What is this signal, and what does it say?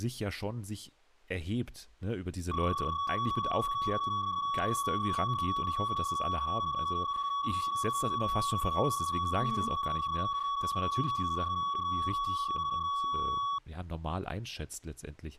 PSK31 (31.25 baud), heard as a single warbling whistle, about 1130 Hz, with speech in German.